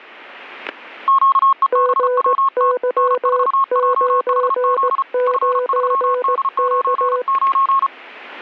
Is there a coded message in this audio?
Yes: Morse code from 1.0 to 7.9 s, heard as two keyed tones, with static crashes. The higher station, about 34 wpm, 1090 Hz: QEBWT N4JHZ F3D99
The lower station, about 18 wpm, 500 Hz: GY99K